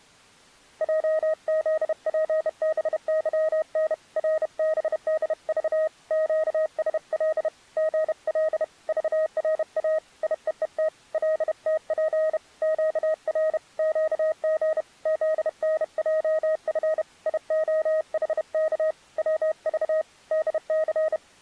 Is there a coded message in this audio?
Yes: Morse code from 0.8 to 21.2 s, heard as a keyed tone, hand-sent with a bug key, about 31 wpm, 630 Hz. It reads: JZPBYN RBDV QSL GL VRA IEET LTP QR QG ZNJF IOHK WV DC